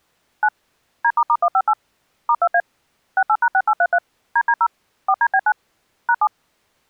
DTMF, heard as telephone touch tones, dialled by machine, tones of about 60 ms. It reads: 9 D**158 *2A 68#6833 DD0 4DB9 #7